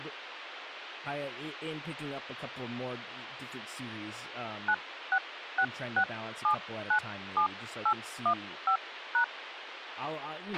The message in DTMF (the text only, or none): 9666797815#